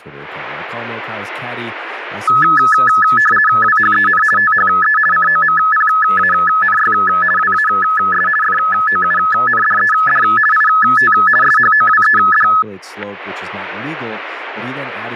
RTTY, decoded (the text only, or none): WHEN THE COMPANY WAS FOUNDED IT SHOWED